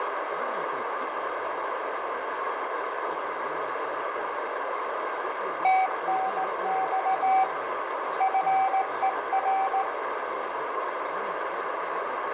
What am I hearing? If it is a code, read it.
Morse code, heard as a keyed tone, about 17 wpm, 760 Hz, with radio static, fading, a narrow filter, room echo and speech in English. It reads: TNX FER